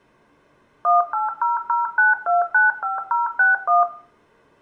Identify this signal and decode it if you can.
DTMF, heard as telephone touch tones, dialled by machine, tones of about 160 ms, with room echo. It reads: 18009295061